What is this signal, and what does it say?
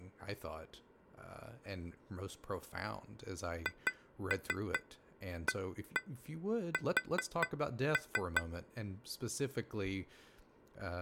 Tap code, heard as taps on glass, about 4 knocks a second, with speech in English. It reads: HAS